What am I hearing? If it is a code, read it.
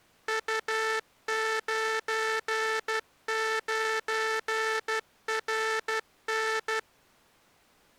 Morse code, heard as a buzzer, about 12 wpm. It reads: U99RN